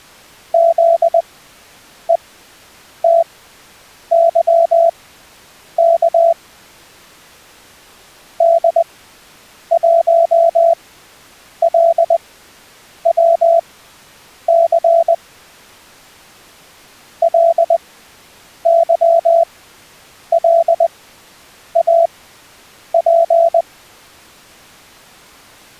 Morse code, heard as a keyed tone, machine-sent, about 20 wpm, spaced as for 8 wpm, 670 Hz. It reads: ZETYK D1LWC LYLAP